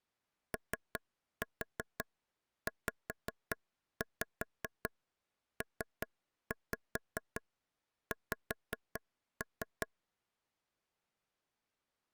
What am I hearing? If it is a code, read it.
Tap code, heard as taps on a table, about 5 knocks a second. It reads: OZPX